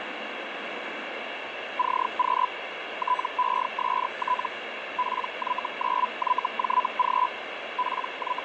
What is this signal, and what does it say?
Hellschreiber (Feld-Hell, 122.5 baud), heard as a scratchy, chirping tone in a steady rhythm, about 1000 Hz, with radio static and the noise inside a subway train. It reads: CQ TEST PY9YJG …